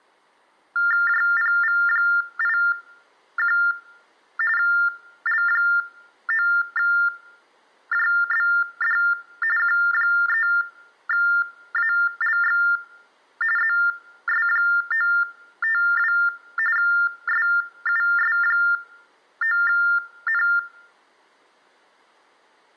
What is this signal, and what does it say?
TTY/TDD text telephone tones (45.45 baud Baudot), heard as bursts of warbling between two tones, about 400 Hz shift, 1600 Hz centre. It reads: JPV81 L9JBD Q3ALX ZS952 SUS9N